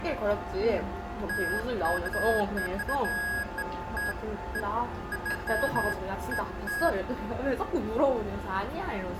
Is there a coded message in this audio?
No, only beeps of irregular length, with room echo and the noise of a restaurant.